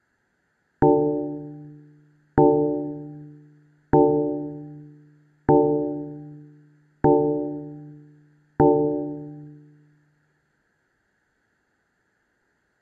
Clock strike, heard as a bell, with room echo. 6. Six o'clock.